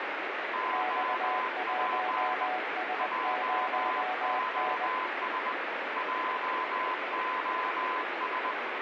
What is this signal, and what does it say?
Morse code, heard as two keyed tones, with heavy radio static. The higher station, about 20 wpm, 1020 Hz: OP JOS JOS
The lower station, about 20 wpm, 740 Hz: X1S0N